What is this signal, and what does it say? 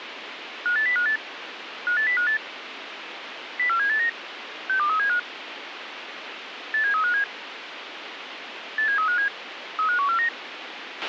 Five-tone selective call (CCIR), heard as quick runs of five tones, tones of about 100 ms, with radio hiss and a squelch burst at the end. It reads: 58058 58058 04789 62375 87357 87357 35149